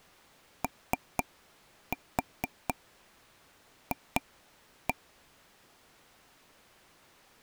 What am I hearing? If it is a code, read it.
Tap code, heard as taps on a table, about 4 knocks a second. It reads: OF